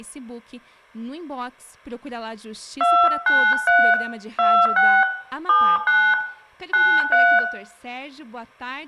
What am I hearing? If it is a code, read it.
DTMF, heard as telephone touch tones, dialled by hand, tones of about 270 ms, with room echo. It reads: 293 26 79 93